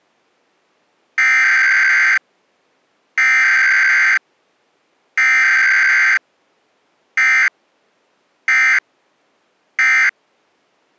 Emergency Alert System (SAME) tones (header bursts, then end-of-message bursts), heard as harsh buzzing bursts, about 520.83 baud.